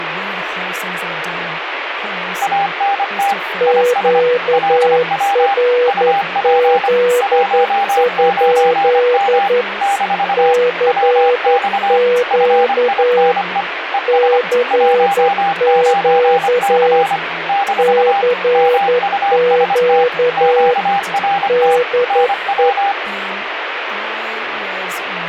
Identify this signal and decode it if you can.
Morse code, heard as two keyed tones, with radio static and speech in English. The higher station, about 25 wpm, 800 Hz: ANT IS LW UP 19M - WX FINE ES 19C - MUST QRT NW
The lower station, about 11 wpm, 490 Hz: QRZ? CQ CQ CQ DE